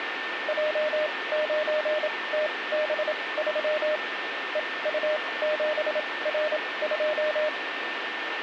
Morse code, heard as a keyed tone, machine-sent, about 27 wpm, spaced as for 20 wpm, 610 Hz, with radio static and a steady whistle near 1800 Hz. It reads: J9TB3 EU7R2